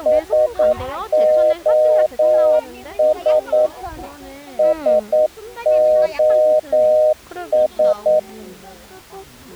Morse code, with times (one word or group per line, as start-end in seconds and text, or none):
0.1-3.7 SOS
4.6-8.2 SOS